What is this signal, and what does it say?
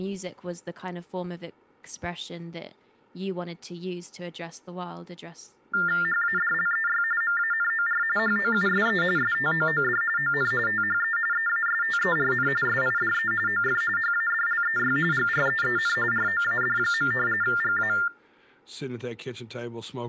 TTY/TDD text telephone tones (45.45 baud Baudot), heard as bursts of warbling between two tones, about 400 Hz shift, 1600 Hz centre, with speech in English. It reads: HADLEY MANOR HOUSE STOOD ON THE EASTERN SIDE OF HADLEY GREEN ROAD. GA